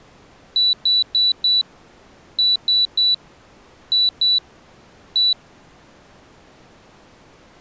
Beep code, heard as a piezo beeper, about 3950 Hz. 4-3-2-1.